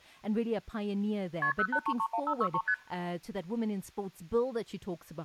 Multi-frequency trunk signalling (R1, as on North American trunks), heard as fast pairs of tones, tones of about 70 ms, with speech in English. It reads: KP 08331563 ST